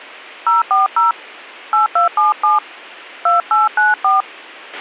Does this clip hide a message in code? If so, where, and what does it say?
Yes: DTMF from 0.5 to 4.2 s, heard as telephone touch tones, dialled by hand, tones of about 150 ms, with a squelch burst at the end. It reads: 040 8277 2894